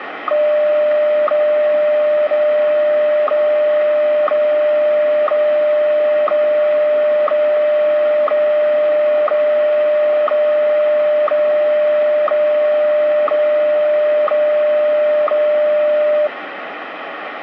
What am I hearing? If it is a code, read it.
Radio time signal (WWVH, Hawaii), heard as ticks, one a second, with radio static.